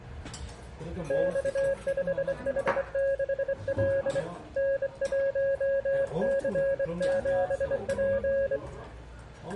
Morse code, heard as a keyed tone, hand-sent with a straight key, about 24 wpm, 550 Hz, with room echo and the noise of a restaurant. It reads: X5H6L N1C7P